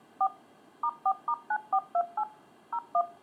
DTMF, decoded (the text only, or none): 4 *4*9428 01